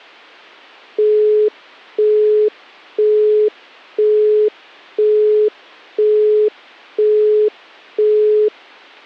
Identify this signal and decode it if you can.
Telephone call progress tone (single-tone plan, as in Europe, Japan and elsewhere), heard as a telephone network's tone, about 420 Hz, 0.5 s on and 0.5 s off. Busy tone.